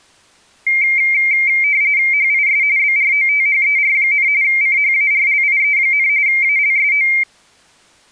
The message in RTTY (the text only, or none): HIS BROTHER, CHARLIE, ALSO